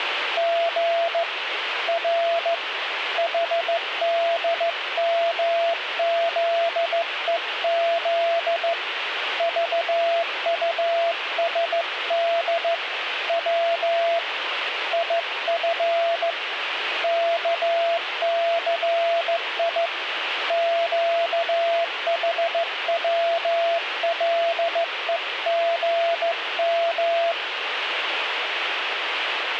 Morse code, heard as a keyed tone, hand-sent with a straight key, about 15 wpm, 680 Hz, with radio static. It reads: G R HDMZEZ VUSD W IF KCI QHWLEGM